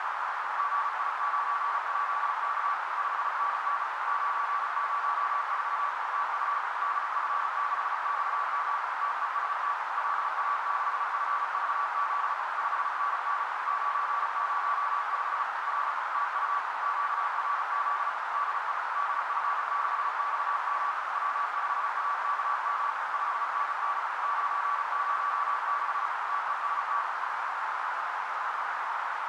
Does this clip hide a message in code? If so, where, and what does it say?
Yes: Morse code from 0.5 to 27.1 s, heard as a keyed tone, machine-sent, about 35 wpm, 1150 Hz, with heavy radio static and a narrow filter. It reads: GI9JK 5NN 904 TU DF6XM TEST LA6FVZ 5NN 905 R TU QRZ DE DF6XM W5AKM 5NN 906 TEST